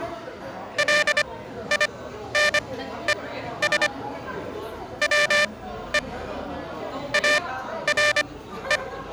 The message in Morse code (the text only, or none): LINES WE ARE